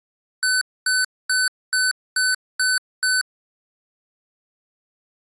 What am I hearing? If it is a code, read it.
Beep code, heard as beeps from a small speaker, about 1500 Hz. 7 short. In AMI BIOS tables: virtual mode exception error; in Dell tables: processor failure.